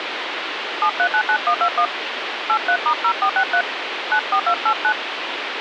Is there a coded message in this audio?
Yes: DTMF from 0.8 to 4.9 s, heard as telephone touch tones, dialled by hand, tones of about 80 ms, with phone line noise. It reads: 7399121 83*0463 94289